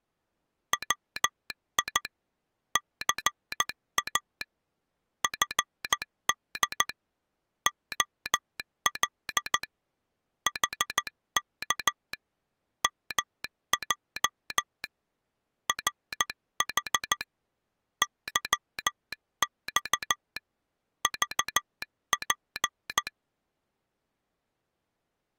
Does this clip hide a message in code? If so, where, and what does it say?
Yes: Morse code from 0.7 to 23.1 s, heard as a telegraph sounder, hand-sent with a paddle, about 14 wpm. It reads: WI CA FD OL HK MJ RH YX VP